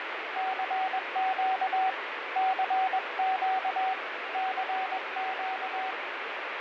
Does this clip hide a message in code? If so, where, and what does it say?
Yes: Morse code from 0.3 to 6.0 s, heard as a keyed tone, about 21 wpm, 760 Hz, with heavy radio static and fading. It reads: CQ CQ CQ